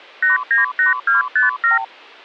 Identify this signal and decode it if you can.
Multi-frequency trunk signalling (R2, with the far end's replies), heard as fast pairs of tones, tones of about 140 ms. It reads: 898257